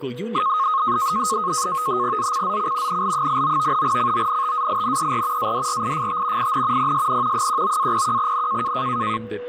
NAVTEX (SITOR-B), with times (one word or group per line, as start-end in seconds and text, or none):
2.2-3.0 ZCZC
2.9-3.8 NL89
3.8-5.5 CONTAINER
5.4-6.5 ADRIFT
6.4-6.9 IN
6.8-7.5 PSN
7.3-8.7 19-01N